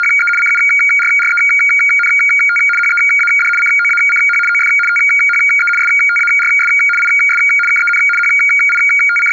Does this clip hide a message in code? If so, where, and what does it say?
Yes: RTTY (75 baud, 850 Hz shift) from 0.0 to 9.3 s, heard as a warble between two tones, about 1850 Hz centre. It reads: … CURRENT HEAD COACH OF THE STARS IS KEN …